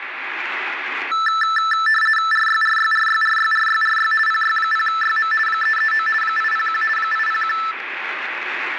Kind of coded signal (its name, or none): RTTY